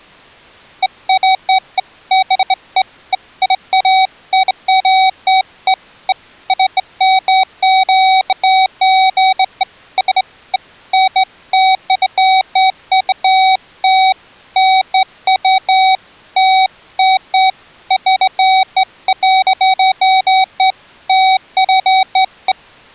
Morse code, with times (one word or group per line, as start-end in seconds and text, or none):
none